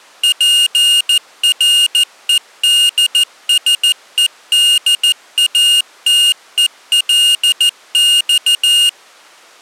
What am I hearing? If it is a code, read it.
Morse code (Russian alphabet), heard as a high beeper, machine-sent, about 14 wpm, 2850 Hz. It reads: ПРЕДСЕДАТЕЛЬ